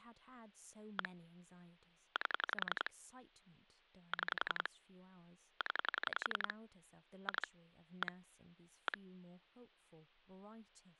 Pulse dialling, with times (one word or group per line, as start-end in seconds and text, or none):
1.0-1.1 1
2.2-2.9 8
4.1-4.7 6
5.6-6.5 0
7.3-7.5 2
8.0-8.1 1
8.9-9.0 1